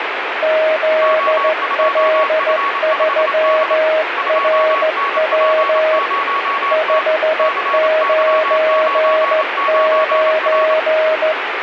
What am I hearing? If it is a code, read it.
Morse code, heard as two keyed tones, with radio static. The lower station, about 15 wpm, 630 Hz: ZL3RW 599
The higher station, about 27 wpm, 1120 Hz: O2F5D 2NP0T CY99R